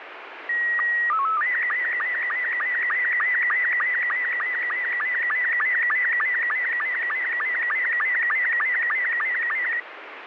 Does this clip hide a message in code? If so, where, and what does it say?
Yes: SSTV (slow-scan television), Robot 72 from 0.5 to 9.8 s, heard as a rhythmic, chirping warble, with radio static.